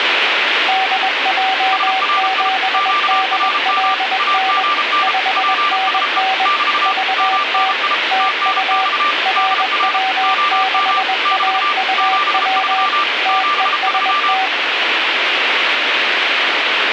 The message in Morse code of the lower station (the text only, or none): DJ7DLN 5NN VT TU RW6AUW TEST